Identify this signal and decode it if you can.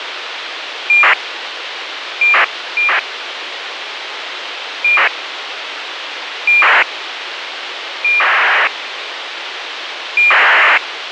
ACARS aircraft data, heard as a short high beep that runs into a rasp, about 2400 baud, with radio hiss.